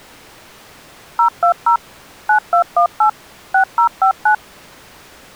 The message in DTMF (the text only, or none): 020 9218 6059